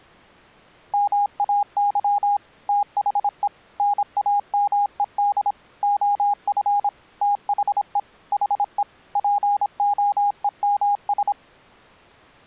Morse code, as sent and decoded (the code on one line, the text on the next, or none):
-- .- -.-- / - .... . / -. .- -- . -.. / --- ..-. / - .... . / .... . / .--. --- . -- ...
MAY THE NAMED OF THE HE POEMS